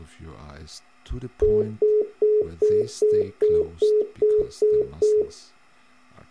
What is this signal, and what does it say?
Telephone call progress tone (single-tone plan, as in most of Europe), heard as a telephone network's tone, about 420 Hz, 0.2 s on and 0.2 s off. Congestion tone.